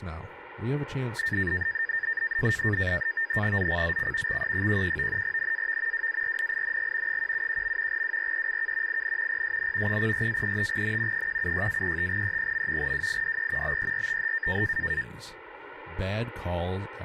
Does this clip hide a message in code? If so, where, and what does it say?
Yes: NAVTEX (SITOR-B), 100 baud, 170 Hz shift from 1.2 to 15.0 s, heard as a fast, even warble, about 1700 Hz centre, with speech in English. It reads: ZCZC XE11 NAV WARNING 171. WRECK IN PSN 04-35N 176-35E. WIDE BERTH